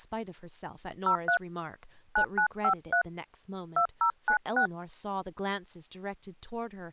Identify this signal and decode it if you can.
DTMF, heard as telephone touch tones, dialled by hand, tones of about 90 ms, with speech in English. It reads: 03 9953 2096